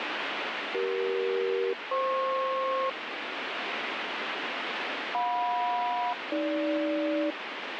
Aircraft SELCAL, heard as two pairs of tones, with radio static. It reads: CE-FP JM-AG